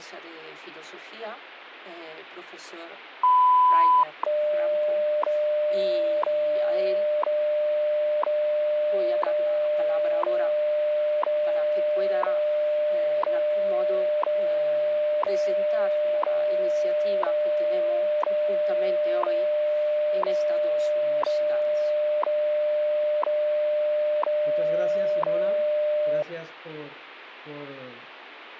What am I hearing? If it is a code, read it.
Radio time signal (WWV, Colorado), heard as ticks, one a second, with radio static.